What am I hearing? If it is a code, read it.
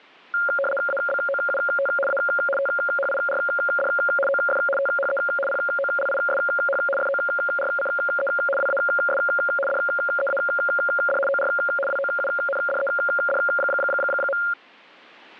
RTTY (75 baud, 850 Hz shift), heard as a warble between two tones, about 980 Hz centre. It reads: ABOUT A THIRD OF THE POLISH FORCE WAS DEAD OR WOUNDED.